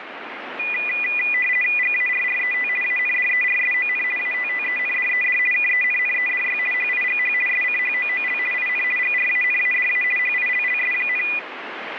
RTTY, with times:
1.8-2.7 GARRET
2.8-4.0 ANDERSON
4.2-5.4 ATTENDED
5.5-6.6 KENNEDY
6.7-7.3 HIGH
7.5-8.4 SCHOOL
8.5-8.8 IN
9.0-10.0 GRANADA
10.2-11.2 HILLS,

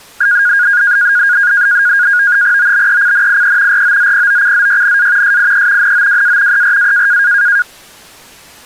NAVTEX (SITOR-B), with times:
2.6-3.8 OBECNIE
3.7-5.4 ROZPOCZYNA
5.2-5.9 SIE
5.8-6.6 NOWA
6.5-7.2 ERA

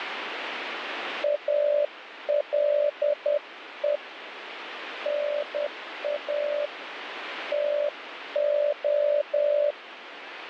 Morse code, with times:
1.2-4.0 ALE
5.1-6.7 NA
7.5-9.7 TO

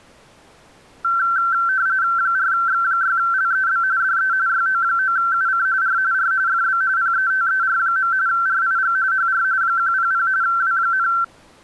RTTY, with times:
2.2-3.8 4X6LEB
4.0-4.3 DE
4.5-5.7 YO9UC
5.8-6.0 R
6.1-6.3 R
6.5-6.8 FB
7.0-8.1 PETER.
8.3-9.0 RIG
9.1-9.4 HR
9.6-10.3 100
10.4-11.1 W,

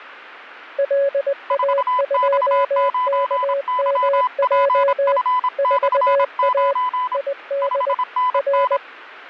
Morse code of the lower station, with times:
0.8-5.2 LA2KMJ
5.6-6.7 4A
7.1-7.9 ID
8.3-8.8 R

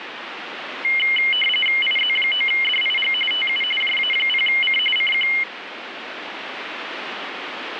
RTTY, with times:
1.8-3.1 IZ9DIG
3.3-3.6 TU
3.8-4.8 JA0C
5.0-5.3 CQ

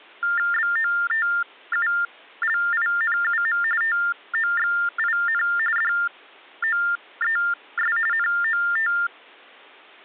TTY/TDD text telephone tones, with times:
0.5-3.6 BOTULINUM
3.8-5.4 TOXIN
5.8-8.0 DOES
8.1-8.9 NOT

